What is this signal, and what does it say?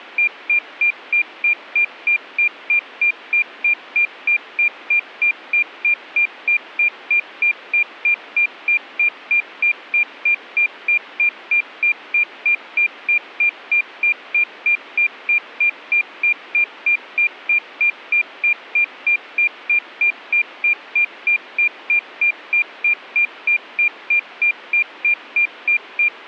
Evenly repeated beeps. There is no code.